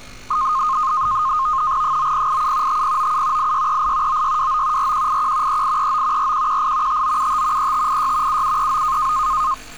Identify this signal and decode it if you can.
NAVTEX (SITOR-B), 100 baud, 170 Hz shift, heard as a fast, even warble, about 1150 Hz centre, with street noise. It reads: 9087 5097 8638 9629 4181 3839 4118 5975 3586 7739